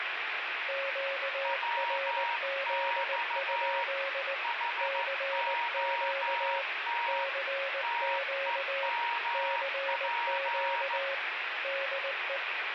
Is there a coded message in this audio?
Yes: Morse code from 0.6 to 12.4 s, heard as two keyed tones, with radio static. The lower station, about 19 wpm, 550 Hz: QRZ? CQ CQ CQ DE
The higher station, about 14 wpm, 940 Hz: WX HOT TEMP